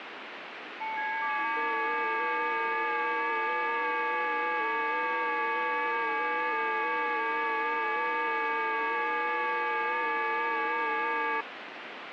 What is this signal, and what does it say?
FT8 (several signals at once), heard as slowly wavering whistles, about 6.25 baud, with radio static.